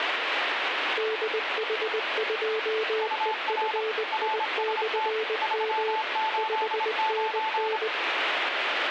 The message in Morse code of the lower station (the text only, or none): DH2EFI/M 5NN